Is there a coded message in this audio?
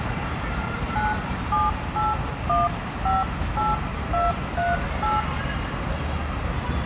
Yes: DTMF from 1.0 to 5.2 s, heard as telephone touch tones, dialled by hand, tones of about 180 ms, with phone line noise, room echo and the noise of a residential street. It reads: 978158238